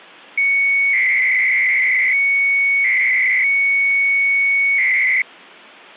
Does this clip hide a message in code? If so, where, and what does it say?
Yes: 300-baud modem data (Bell 103 tones) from 0.4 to 5.2 s, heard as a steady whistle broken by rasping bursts, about 300 baud, 200 Hz shift.